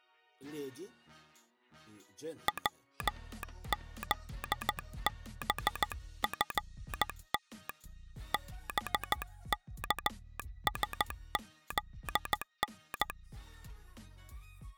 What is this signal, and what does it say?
Morse code (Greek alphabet), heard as a telegraph sounder, hand-sent with a straight key, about 14 wpm. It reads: ΩΖΒΦΤ ΒΚΣΖΝ